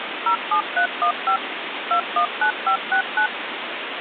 DTMF, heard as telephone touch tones, dialled by machine, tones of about 90 ms, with phone line noise. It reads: 07315 219569